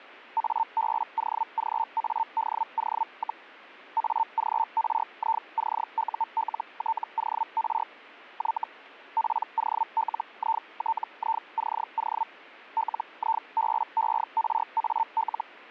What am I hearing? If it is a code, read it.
Hellschreiber (Feld-Hell, 122.5 baud), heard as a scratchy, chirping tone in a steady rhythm, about 900 Hz. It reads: ABOGADO, AGRICULTOR Y POLITICO LIBERAL